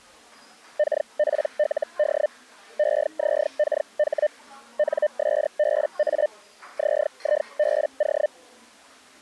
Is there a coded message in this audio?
Yes: Hellschreiber (Feld-Hell, 122.5 baud) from 0.8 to 8.3 s, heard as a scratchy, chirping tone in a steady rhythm, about 600 Hz, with the noise of a cafe. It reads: KPLD EZKH NSBA ZIBO